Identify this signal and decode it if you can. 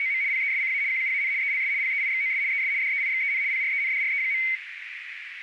RTTY (75 baud, 170 Hz shift), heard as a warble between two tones, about 2150 Hz centre, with radio static and a narrow filter. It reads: … PESCA QUAN ELS PEIXOS ES DEIXEN PRENDRE.